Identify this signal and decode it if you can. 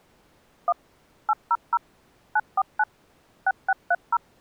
DTMF, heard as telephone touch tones, dialled by machine, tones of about 50 ms. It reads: 1 800 949 6630